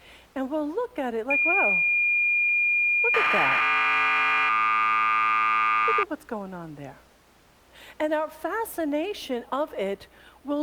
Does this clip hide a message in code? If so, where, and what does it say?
Yes: cassette data (Kansas City type), 1200 baud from 1.3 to 6.0 s, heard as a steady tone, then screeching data, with speech in English.